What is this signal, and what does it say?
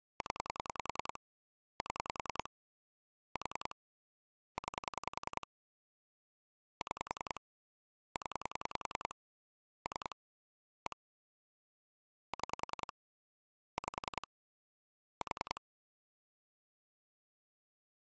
Pulse dialling, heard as clicks on a phone line, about 10 pulses a second. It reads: 0 7 4 9 6 0 3 1 6 5 4